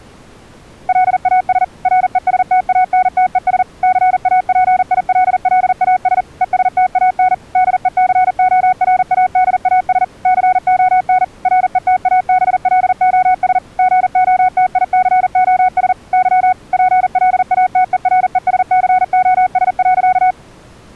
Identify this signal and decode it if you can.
Morse code, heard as a keyed tone, machine-sent, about 40 wpm, 740 Hz. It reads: LAS RESTANTES CAPILLAS ESTAN DECORADAS CON RETABLOS GOTICOS Y PLATERESCOS.